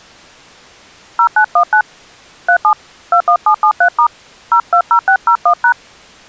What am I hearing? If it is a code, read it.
DTMF, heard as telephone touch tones, dialled by hand, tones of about 80 ms. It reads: 0919 37 21773* 020601#